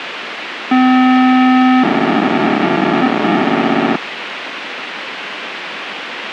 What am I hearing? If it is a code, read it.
POCSAG pager data (512 baud), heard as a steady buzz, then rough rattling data, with radio hiss and a squelch burst at the end.